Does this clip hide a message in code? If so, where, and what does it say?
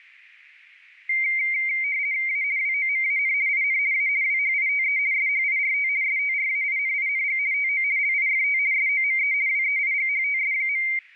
Yes: RTTY (50 baud, 170 Hz shift) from 1.1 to 11.0 s, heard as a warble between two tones, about 2200 Hz centre. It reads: A WOMAN IN A WHITE SHIRT STRAINING TO LIFT SOME WEIGHTS.